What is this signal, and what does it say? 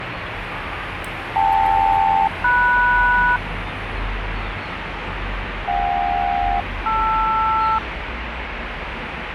Aircraft SELCAL, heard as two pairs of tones, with radio static and street noise. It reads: KL-MS JK-LR